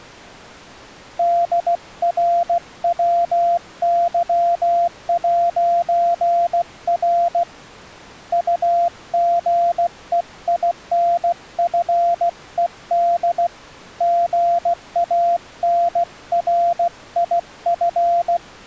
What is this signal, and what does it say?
Morse code, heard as a keyed tone, hand-sent with a paddle, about 16 wpm, 690 Hz. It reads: DRWY'R UGEINFED GANRIF